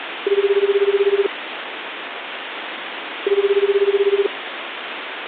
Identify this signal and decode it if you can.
Telephone call progress tone (Japanese plan), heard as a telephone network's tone, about 380, 400, 420 Hz, 1 s on and 2 s off, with phone line noise. Ringback tone.